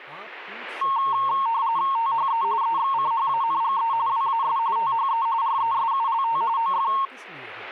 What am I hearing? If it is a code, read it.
RTTY (45.45 baud, 170 Hz shift), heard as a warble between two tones, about 1000 Hz centre, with speech in Hindi. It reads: THE EXCHANGE WAS THE RESULT OF